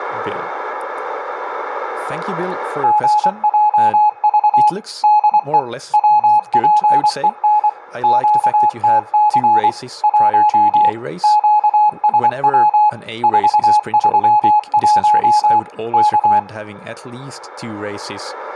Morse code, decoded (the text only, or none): GJV DE WPEN QTC 1 QSW 431 K